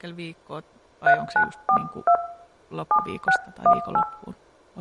DTMF, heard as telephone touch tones, dialled by hand, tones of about 80 ms, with speech in Finnish. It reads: 3942 7618